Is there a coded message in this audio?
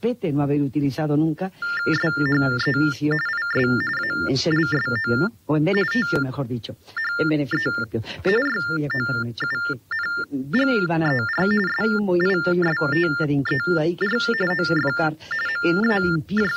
Yes: TTY/TDD text telephone tones (45.45 baud Baudot) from 1.6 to 16.6 s, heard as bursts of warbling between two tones, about 400 Hz shift, 1600 Hz centre. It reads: SHE IS ALSO THE YOUNGER SISTER OF …